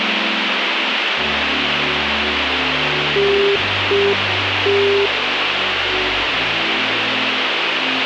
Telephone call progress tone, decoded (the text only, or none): congestion tone